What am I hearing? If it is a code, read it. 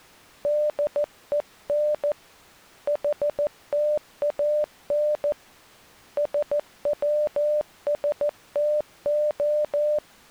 Morse code (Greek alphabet), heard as a keyed tone, hand-sent with a paddle, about 14 wpm, 600 Hz. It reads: ΔΕΝ ΗΤΑΝ ΣΩΣΤΟ